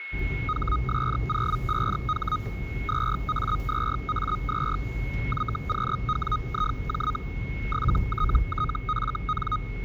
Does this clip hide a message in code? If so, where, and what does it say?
Yes: Hellschreiber (Feld-Hell, 122.5 baud) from 0.5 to 9.6 s, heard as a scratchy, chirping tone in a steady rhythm, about 1250 Hz, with a steady whistle near 2180 Hz and the noise inside a car. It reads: HS05H 2A2A2 YQWIJ 7TTFN